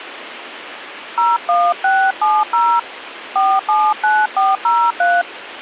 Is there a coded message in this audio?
Yes: DTMF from 1.2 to 5.2 s, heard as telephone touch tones, dialled by hand, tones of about 230 ms, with phone line noise. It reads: 01670 479403